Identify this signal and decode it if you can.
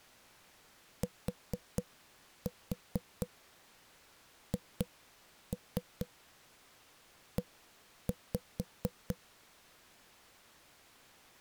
Tap code, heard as knocks on a wall, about 4 knocks a second. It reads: THE